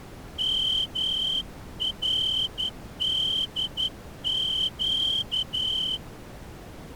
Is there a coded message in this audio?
Yes: Morse code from 0.3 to 6.0 s, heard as a whistle, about 11 wpm. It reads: MRDQ